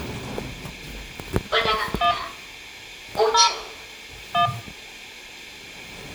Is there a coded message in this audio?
Yes: DTMF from 2.0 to 4.5 s, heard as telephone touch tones, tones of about 120 ms, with the noise inside a lift. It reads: 1 0 1